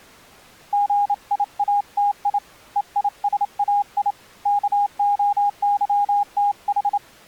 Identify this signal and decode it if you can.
Morse code (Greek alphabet), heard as a keyed tone, hand-sent with a straight key, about 27 wpm, 820 Hz. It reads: ΓΙΑΤΙ ΕΙΣΑΙ ΚΟΥΤΗ